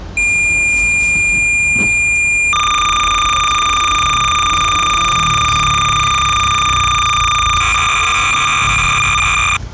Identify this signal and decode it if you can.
Cassette data (Kansas City type), 300 baud, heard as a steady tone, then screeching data, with the noise of a residential street.